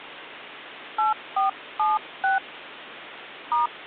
DTMF, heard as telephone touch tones, dialled by hand, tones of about 160 ms, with phone line noise and hum. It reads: 8476 *